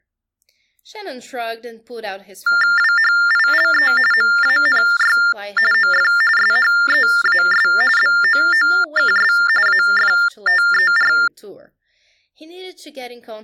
TTY/TDD text telephone tones (45.45 baud Baudot), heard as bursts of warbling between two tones, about 400 Hz shift, 1600 Hz centre, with speech in English. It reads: WHILE MANY OF SHEAS BOOKS AFTER